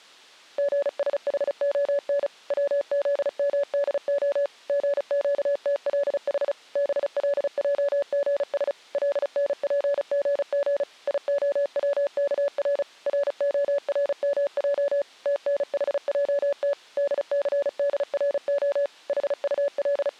Morse code (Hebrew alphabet), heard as a keyed tone, machine-sent, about 35 wpm, 570 Hz. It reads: גשחהן צזמדה גקתלח בלעגש לנפגג יהצכר רהרמע תנחעת דסדרה …